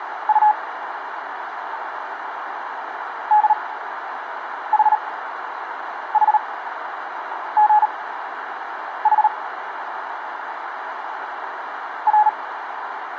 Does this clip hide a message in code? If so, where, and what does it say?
Yes: Morse code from 0.2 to 12.3 s, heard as a keyed tone, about 38 wpm, spaced as for 7 wpm, 850 Hz, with radio static and a narrow filter. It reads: U DHHGH R